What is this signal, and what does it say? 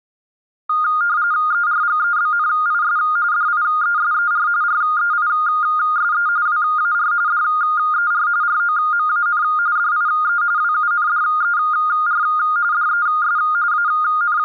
RTTY (45.45 baud, 170 Hz shift), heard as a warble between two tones, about 1320 Hz centre. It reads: ERGEBNIS DIESER REISE WAR DER ROMAN DIE WUNDER DES …